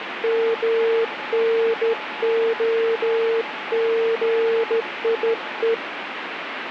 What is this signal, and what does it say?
Morse code (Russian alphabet), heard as a keyed tone, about 14 wpm, 460 Hz, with radio static and a weaker station near 860 Hz. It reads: МНОГИЕ